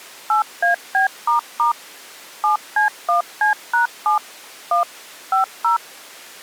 DTMF, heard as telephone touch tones, dialled by machine, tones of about 120 ms. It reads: 8AB** 7C1C#7 1 50